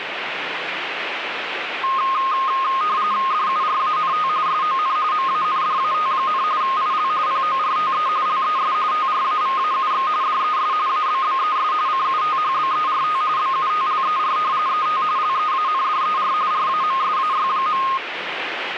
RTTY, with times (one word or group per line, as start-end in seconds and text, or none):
3.3-4.3 DURANT
4.5-5.0 SON
5.1-6.4 MANDAT,
6.6-7.1 IL
7.3-8.1 PORTE
8.3-8.7 LES
8.9-10.1 TRAVAUX
10.2-10.7 DES
10.9-11.7 ABBES
11.9-13.2 CUTHBERT
13.4-14.4 BUTLER
14.7-15.0 ET
15.2-16.3 LEANDER
16.5-17.8 RAMSAY.